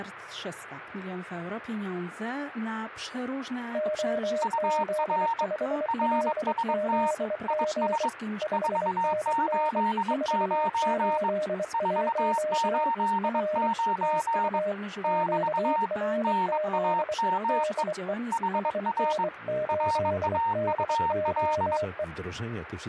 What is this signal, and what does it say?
Morse code, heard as two keyed tones. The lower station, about 24 wpm, 610 Hz: OZ5LZG 5NN 481 R TU QRZ DE SN8DOE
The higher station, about 22 wpm, 920 Hz: UR RST IS 489 489 <BT> NAME HR RAUL